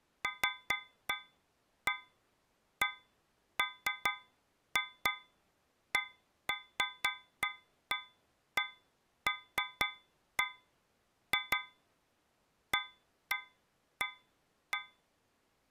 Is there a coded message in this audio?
No, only irregular taps on a metal pipe.